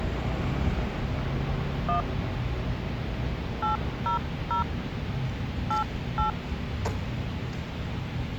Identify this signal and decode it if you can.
DTMF, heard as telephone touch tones, dialled by hand, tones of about 120 ms, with street noise. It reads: 1 800 88